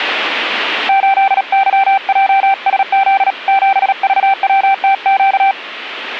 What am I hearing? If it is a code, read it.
Morse code, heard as a keyed tone, hand-sent with a paddle, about 37 wpm, 780 Hz. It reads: 8YJSZ 7VWTQ